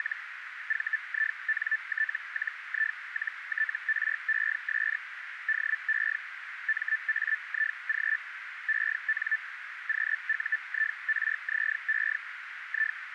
Hellschreiber (Feld-Hell, 122.5 baud), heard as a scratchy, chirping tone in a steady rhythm, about 1750 Hz, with radio static and a narrow filter. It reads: … VINT-I-TRES DE MAIG EN QUIRZE I